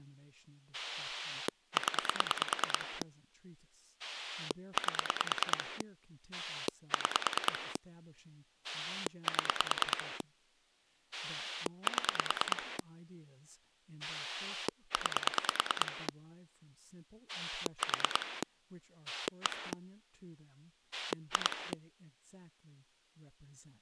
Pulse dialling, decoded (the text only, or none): 0 8 6 7 7 9 4 1 2